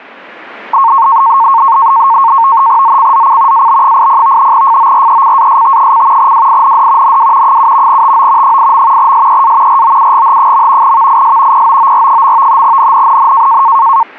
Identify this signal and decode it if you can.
NAVTEX (SITOR-B), 100 baud, 170 Hz shift, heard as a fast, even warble, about 1000 Hz centre. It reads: ZCZC AB80 FORECAST: WIND NW 7 TO 8. SEA ROUGH. VIS POOR. NNNN